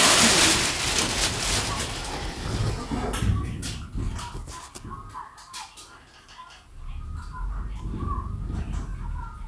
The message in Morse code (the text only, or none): none